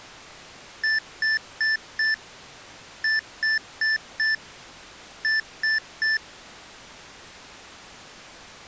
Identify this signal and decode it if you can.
Beep code, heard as beeps from a small speaker, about 1750 Hz. 4-4-3. In Phoenix BIOS tables: maths coprocessor failure.